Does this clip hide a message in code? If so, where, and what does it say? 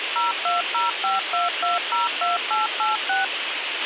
Yes: DTMF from 0.2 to 3.2 s, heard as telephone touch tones, dialled by machine, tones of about 160 ms, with radio hiss and a squelch burst at the end. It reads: 02052202886